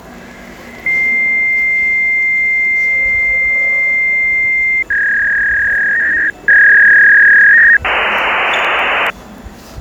Fax machine handshake, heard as a long tone, a warble and hiss, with the noise of a subway station.